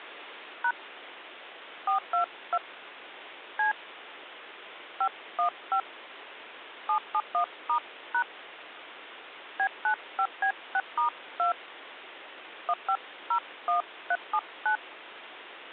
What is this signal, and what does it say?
DTMF, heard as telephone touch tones, dialled by hand, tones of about 90 ms, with phone line noise. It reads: # 422 C 515 771*# B95B6*2 1501379